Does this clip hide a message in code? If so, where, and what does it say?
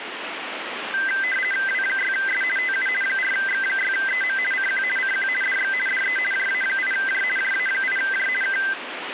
Yes: RTTY (50 baud, 450 Hz shift) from 0.9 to 8.7 s, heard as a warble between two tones, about 1800 Hz centre, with radio static. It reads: W6S TU 4X6EM CQ CQ DX DE JA8J JA8J K